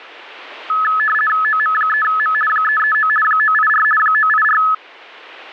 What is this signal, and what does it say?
RTTY (50 baud, 450 Hz shift), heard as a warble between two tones, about 1500 Hz centre, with radio static. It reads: OM3M 339 984 984